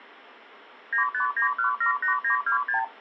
Multi-frequency trunk signalling (R2, with the far end's replies), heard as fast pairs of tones, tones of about 110 ms. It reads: 959178926